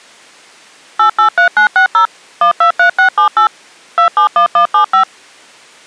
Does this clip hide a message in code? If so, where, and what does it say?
Yes: DTMF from 1.0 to 5.0 s, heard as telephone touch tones, dialled by machine, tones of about 100 ms. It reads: 883960 123678 271175